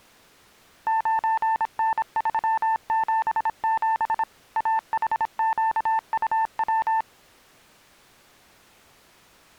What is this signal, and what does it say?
Morse code, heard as a keyed tone, machine-sent, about 26 wpm, 890 Hz. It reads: 9N377 AHQUW